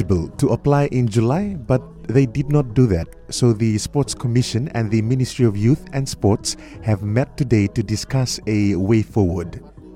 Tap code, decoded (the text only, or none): none